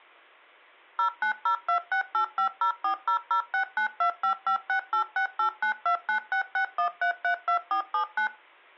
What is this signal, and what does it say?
DTMF, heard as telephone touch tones, dialled by machine, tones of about 100 ms. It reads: 09026850400692556868929661332479